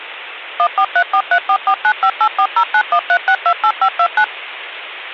DTMF, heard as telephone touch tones, dialled by machine, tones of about 70 ms. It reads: 143434495840913628529